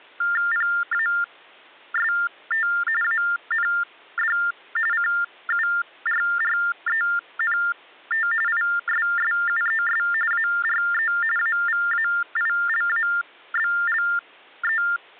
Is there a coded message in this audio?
Yes: TTY/TDD text telephone tones (45.45 baud Baudot) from 0.2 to 15.0 s, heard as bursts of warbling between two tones, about 400 Hz shift, 1600 Hz centre. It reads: PAST AND CURRENT ISSUES ARE AVAILABLE